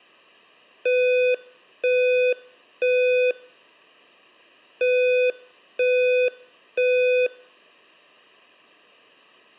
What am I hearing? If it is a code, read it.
Alarm pattern, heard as an alarm's beeps, played twice, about 500 Hz. Temporal three. Smoke or fire, evacuate.